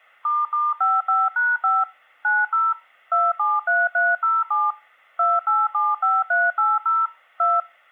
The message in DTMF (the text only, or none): **55#5 90 273307 2875380 2